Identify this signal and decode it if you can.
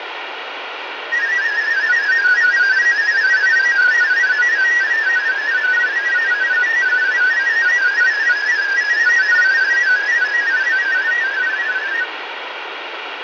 Multi-tone FSK (Olivia or MFSK type), about 500 Hz wide, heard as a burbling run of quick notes, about 31.25 baud, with radio static.